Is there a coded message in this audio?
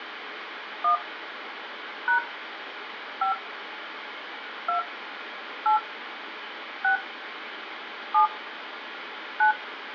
Yes: DTMF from 0.8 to 9.5 s, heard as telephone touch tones, dialled by hand, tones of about 110 ms, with phone line noise. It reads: 1 # 5 2 8 6 7 9